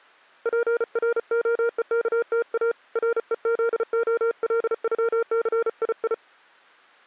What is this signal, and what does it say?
Morse code (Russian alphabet), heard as a keyed tone, hand-sent with a paddle, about 34 wpm, 470 Hz. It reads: ПРОЕКТА РЕЗОЛЮЦИИ